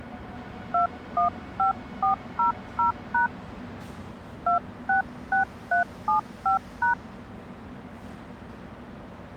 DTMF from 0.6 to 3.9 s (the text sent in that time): 215400#